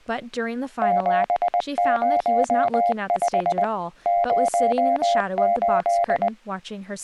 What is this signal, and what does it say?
Morse code, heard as a keyed tone, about 20 wpm, 700 Hz, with speech in English. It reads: 705 08